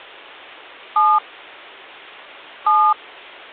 DTMF, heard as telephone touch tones, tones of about 260 ms. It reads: 7 7